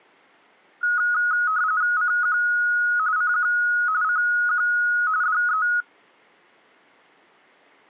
RTTY (45.45 baud, 170 Hz shift), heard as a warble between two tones, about 1360 Hz centre. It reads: CQ CQ CQ DE